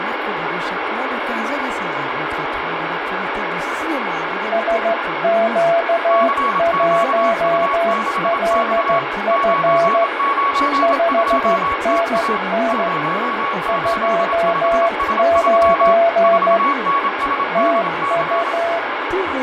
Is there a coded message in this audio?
Yes: Morse code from 4.5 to 18.8 s, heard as two keyed tones, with radio static and fading. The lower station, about 14 wpm, 680 Hz: SQ1LF 5NN 29 TU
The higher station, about 27 wpm, 1120 Hz: CQU6X 992TA 085S3 4NSDC